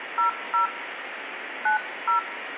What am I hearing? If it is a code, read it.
DTMF, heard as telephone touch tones, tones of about 120 ms, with phone line noise. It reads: 00 90